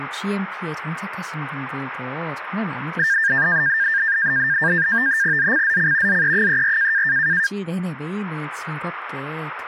NAVTEX (SITOR-B), 100 baud, 170 Hz shift, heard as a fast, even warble, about 1700 Hz centre, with speech in Korean. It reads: ZCZC ZE34